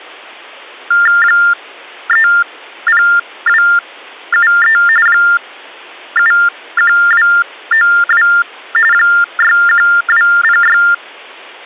TTY/TDD text telephone tones (45.45 baud Baudot), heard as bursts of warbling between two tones, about 400 Hz shift, 1600 Hz centre. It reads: 30273 71292 61206